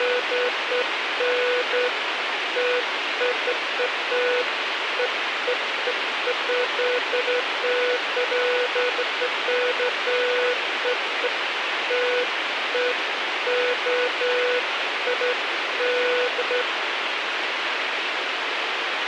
Beeps of irregular length, with radio hiss. There is no code.